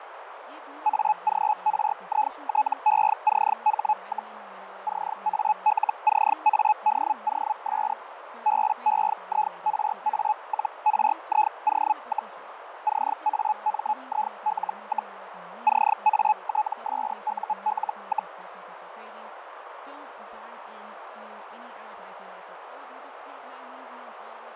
Hellschreiber (Feld-Hell, 122.5 baud), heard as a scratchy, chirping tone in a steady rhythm, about 850 Hz, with radio static, fading, a narrow filter and speech in English. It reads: AGRITECH, CALCADOS BEIRA-RIO, CAMIL, CATSUL,